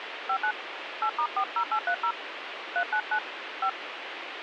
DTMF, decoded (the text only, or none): 59 8*40830 399 5